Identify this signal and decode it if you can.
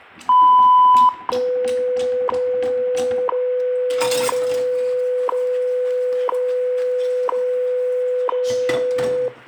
Radio time signal (WWV, Colorado), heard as ticks, one a second, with room echo and kitchen noise.